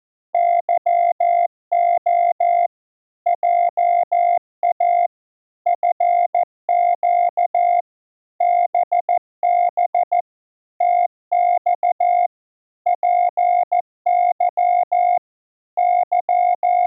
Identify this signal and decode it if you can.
Morse code, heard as a keyed tone, machine-sent, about 14 wpm, 700 Hz. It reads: YO JA FQ BB TX PY …